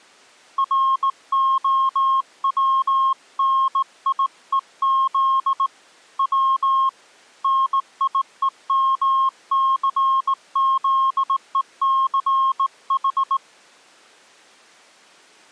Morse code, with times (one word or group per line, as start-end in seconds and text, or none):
0.6-5.7 ROWNIEZ
6.2-6.9 W
7.4-13.4 NIEMCZECH